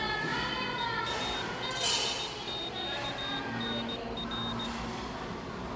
Morse code, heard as a high beeper, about 17 wpm, 3700 Hz, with the noise of a cafe. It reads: EA5QNR